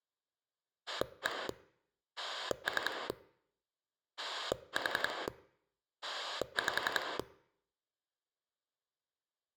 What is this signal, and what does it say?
Pulse dialling, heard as a rotary dial, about 11 pulses a second. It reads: 1 3 4 5